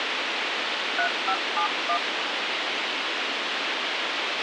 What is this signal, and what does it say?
DTMF, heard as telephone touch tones, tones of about 90 ms, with radio hiss and a squelch burst at the end. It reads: 3571